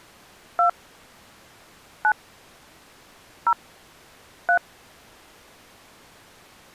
DTMF, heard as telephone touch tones, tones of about 90 ms. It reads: 2 9 0 3